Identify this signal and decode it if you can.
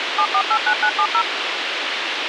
DTMF, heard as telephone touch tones, dialled by machine, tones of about 70 ms, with radio hiss. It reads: 7489970